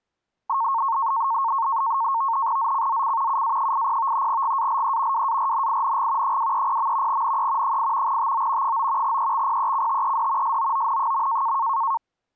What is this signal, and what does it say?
NAVTEX (SITOR-B), 100 baud, 170 Hz shift, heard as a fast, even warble, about 1000 Hz centre. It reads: ZCZC UA80 GALE WARNING 230. NE 8 TO 9 EXPECTED SOON.